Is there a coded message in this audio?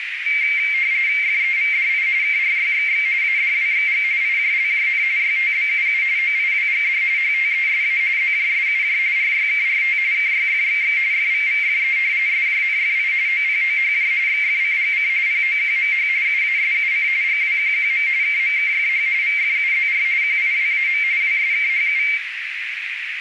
Yes: RTTY (45.45 baud, 170 Hz shift) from 0.3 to 22.2 s, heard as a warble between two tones, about 2200 Hz centre, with radio static and a narrow filter. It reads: FEVDI KRYXX ADWXG IJLJN YTBUU OIWGD HTESA ZJSUJ RYKRT KYFXX FVVFE SJNFI OPOHJ XFCGC POQMH UASUC GWQQM KMKFH VFUZR QIWAM WSKHU